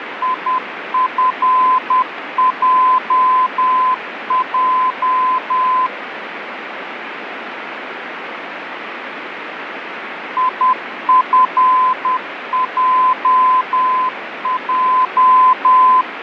Morse code, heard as a keyed tone, machine-sent, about 10 wpm, 1020 Hz, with radio static. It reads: IFJJ IFJJ